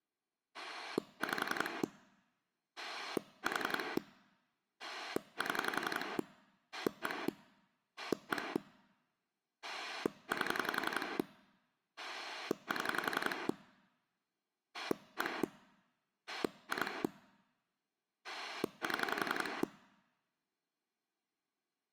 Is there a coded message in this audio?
Yes: pulse dialling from 0.5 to 19.6 s, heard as a rotary dial, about 11 pulses a second. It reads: 5 4 7 1 1 8 7 1 2 7